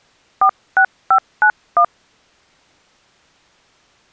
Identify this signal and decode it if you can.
DTMF, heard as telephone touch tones, dialled by hand, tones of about 80 ms. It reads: 46591